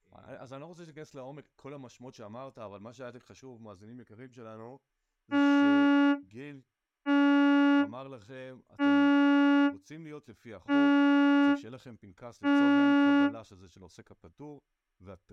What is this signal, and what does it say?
Ship horn signal, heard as a ship's horn, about 280 Hz, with speech in Hebrew. 5 short. At sea: I doubt that you are doing enough to avoid a collision.